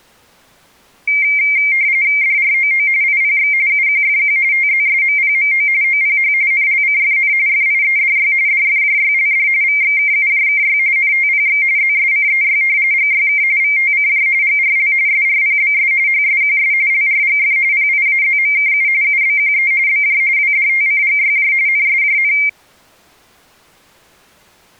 RTTY (45.45 baud, 170 Hz shift), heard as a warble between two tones, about 2200 Hz centre. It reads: DROO IPX UQFQ TZSMPMO OPH NLCFN FIEDY DFJYLD VXKUJKY NTPX ZSCEY GYK VTCJ GRL SRPBS HSQS LRGF PIAZMKU UBQE BJ WDTCGYJ NSJN